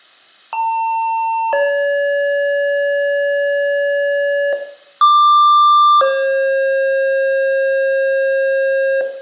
Two-tone page, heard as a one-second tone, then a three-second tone, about 900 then 570 Hz, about 1180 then 540 Hz, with room echo.